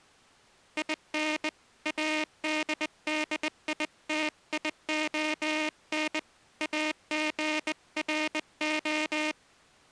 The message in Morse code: IN ADDITION AGRO

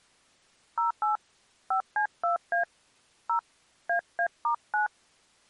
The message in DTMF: 08 5C2A 0 AA*9

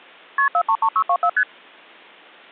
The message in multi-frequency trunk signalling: KP 433624 ST

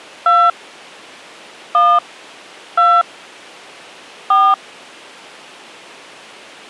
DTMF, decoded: 2 1 2 4

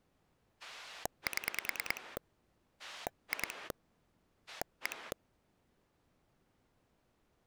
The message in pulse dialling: 7 2 1

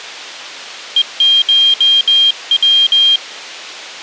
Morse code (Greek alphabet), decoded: ΕΧΩ

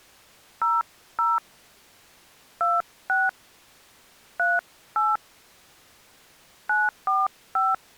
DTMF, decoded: 00 26 38 945

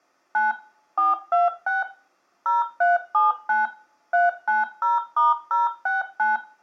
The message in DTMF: 9 426 0379 390*069

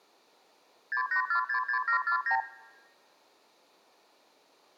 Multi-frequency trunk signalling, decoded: 68466749

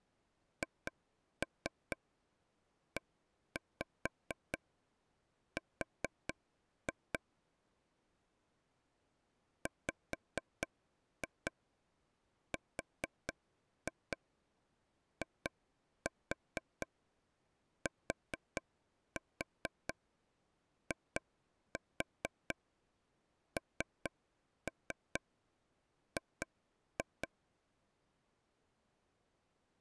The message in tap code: HER WRITING

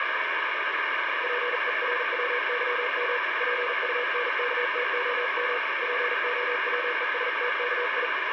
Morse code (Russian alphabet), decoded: ПЕРВЫМ ПУНКТОМ ПОВЕСТКИ

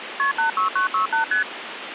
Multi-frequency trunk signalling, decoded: KP 86968 ST

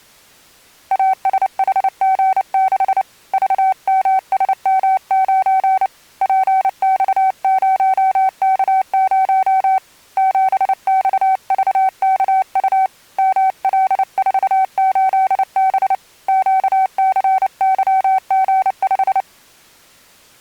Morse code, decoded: ASHG6 VMSM9 PX0K0 7XVKU ML48B QCYG5

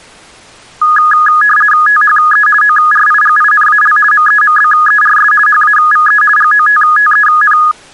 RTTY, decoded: THE ORIGINAL MEMBERS HAVE GOTTEN

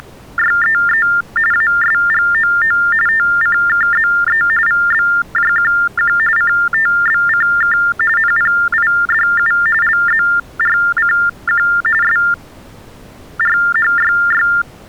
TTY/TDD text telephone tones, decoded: … ASGOO TCKZE VBJQQ CTBCK NPIDU LZRCQ SRHYY

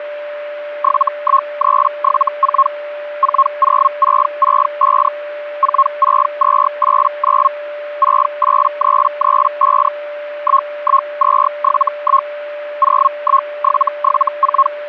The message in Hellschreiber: 71374 40665 46289 68335 11271 01774

